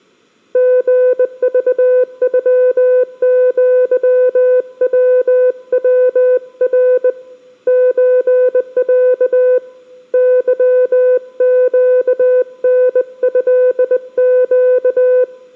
Morse code (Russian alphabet), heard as a keyed tone, hand-sent with a bug key, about 20 wpm, 500 Hz, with room echo. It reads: ГЖЮЪВВР ЧЯ ЫЩНЭЩ